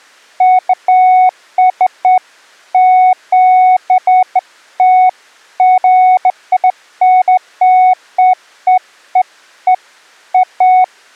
Beeps of irregular length. There is no code.